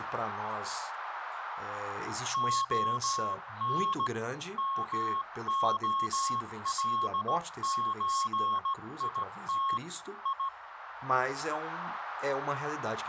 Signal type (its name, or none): Morse code